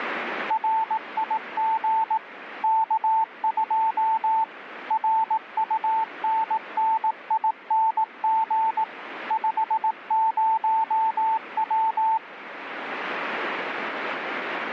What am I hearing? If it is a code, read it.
Morse code, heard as a keyed tone, machine-sent, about 18 wpm, 890 Hz, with radio static. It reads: RIG K2 RUNNING 50W